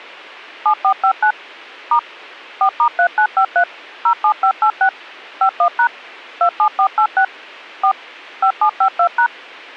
DTMF, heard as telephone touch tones, dialled by machine, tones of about 80 ms. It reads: 7459 * 4*3953 07586 51# 27486 4 5752#